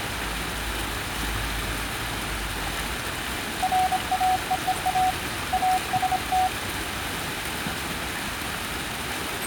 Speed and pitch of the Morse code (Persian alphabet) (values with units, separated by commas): 26 wpm, 740 Hz